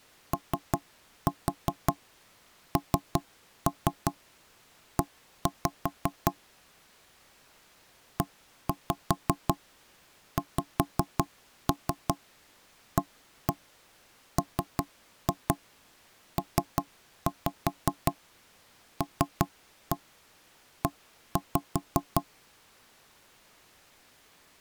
Tap code, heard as knocks on wood, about 5 knocks a second. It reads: ONE EXAMPLE